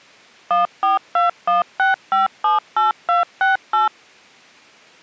DTMF, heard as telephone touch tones, dialled by machine, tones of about 150 ms. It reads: 14216578268